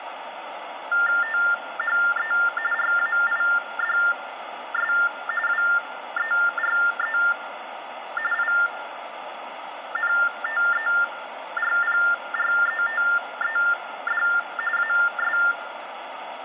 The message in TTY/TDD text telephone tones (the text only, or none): THE RAIDS WERE INTERPRETED AS